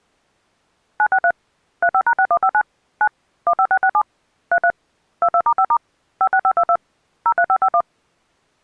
DTMF, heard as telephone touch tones, dialled by machine, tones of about 70 ms. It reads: 963 35#6159 9 15667 33 22*5* 56522 03551